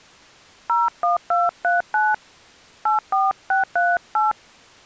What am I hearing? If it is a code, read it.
DTMF, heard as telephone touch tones, dialled by hand, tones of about 180 ms. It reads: 01239 84638